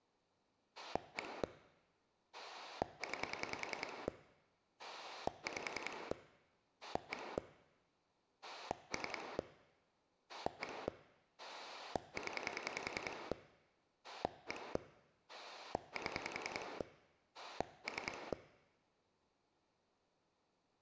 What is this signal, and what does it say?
Pulse dialling, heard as a rotary dial, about 10 pulses a second, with room echo. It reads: 1 9 5 1 3 1 0 1 7 3